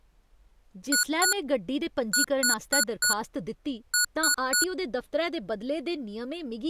Beep code, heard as beeps from a small speaker, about 1460 Hz, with speech in Dogri. 2-4-3.